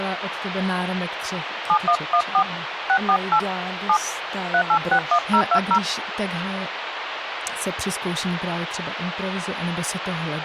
DTMF, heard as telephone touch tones, dialled by hand, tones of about 80 ms, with phone line noise and speech in Czech. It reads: 7114 648 7 3861020